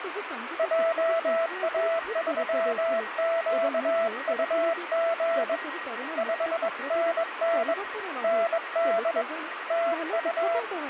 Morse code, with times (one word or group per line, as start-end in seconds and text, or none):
0.6-5.6 JA3QUG
6.2-7.7 5NN
8.2-9.2 ND
9.7-10.6 TU